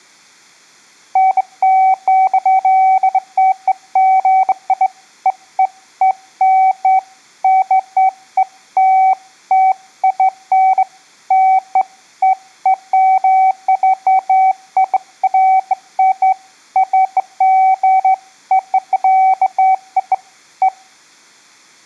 Beeps of irregular length. There is no code.